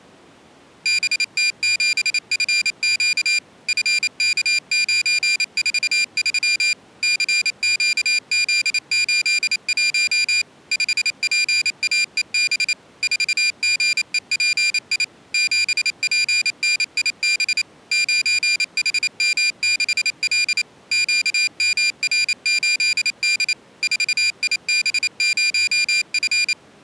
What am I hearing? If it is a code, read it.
Morse code, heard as a high beeper, machine-sent, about 28 wpm, 2400 Hz. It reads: BT7FQ FK943 CQZ81 5PAEB 4GEPI 7PNIB 9HM6L QMR8D 4IB0F